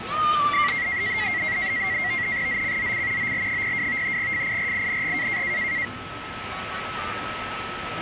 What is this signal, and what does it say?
NAVTEX (SITOR-B), 100 baud, 170 Hz shift, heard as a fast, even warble, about 2050 Hz centre, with radio static, a steady whistle near 1300 Hz and the noise of a park. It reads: ZCZC OL02 FIRING